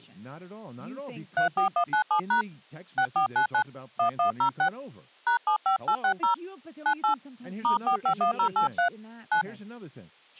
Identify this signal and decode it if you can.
DTMF, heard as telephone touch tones, dialled by hand, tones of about 100 ms, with speech in English. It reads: 34197# 6499 1106 #75860 98 *451083 9